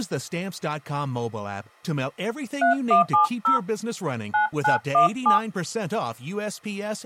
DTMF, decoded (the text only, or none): 3170 9917